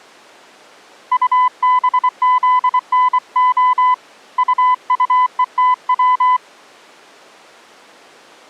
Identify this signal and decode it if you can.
Morse code, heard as a keyed tone, hand-sent with a paddle, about 24 wpm, 1000 Hz. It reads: UBZNO UUETW